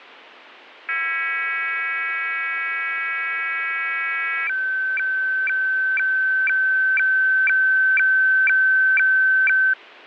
Weather fax (radiofax), 120 lines a minute, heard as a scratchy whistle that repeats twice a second, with radio static and fading.